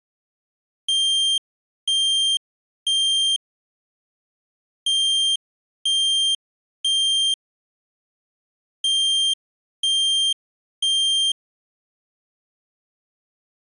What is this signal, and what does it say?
Alarm pattern, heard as an alarm's beeps, played three times, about 3200 Hz. Temporal three. Smoke or fire, evacuate.